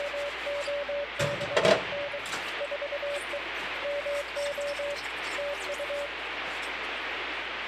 Morse code, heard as a keyed tone, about 23 wpm, 570 Hz, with radio static and kitchen noise. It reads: … 4E MO TU